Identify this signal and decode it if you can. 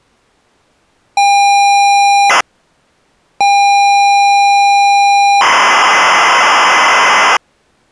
ZX Spectrum tape loading, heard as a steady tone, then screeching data.